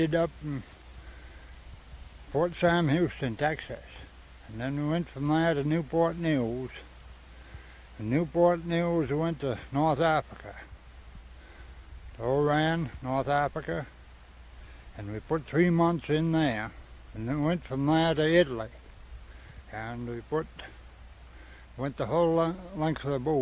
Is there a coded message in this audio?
No.